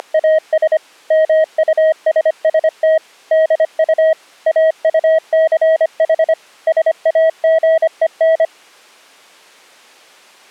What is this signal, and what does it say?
Morse code, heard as a keyed tone, machine-sent, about 25 wpm, 640 Hz. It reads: … MUSST DU AUCH SAGEN